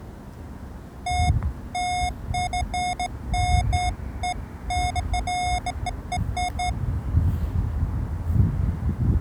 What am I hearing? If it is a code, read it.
Beeps of irregular length, with the noise of a residential street. There is no code.